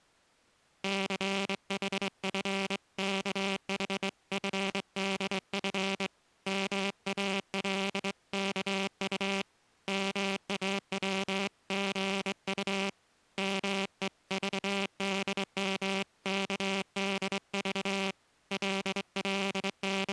Morse code (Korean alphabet), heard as a buzzer, hand-sent with a straight key, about 23 wpm. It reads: 춘우는 목이 몹시 마름을 …